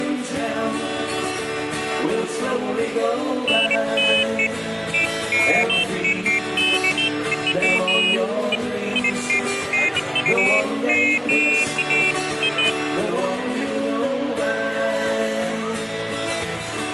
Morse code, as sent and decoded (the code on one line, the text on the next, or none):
none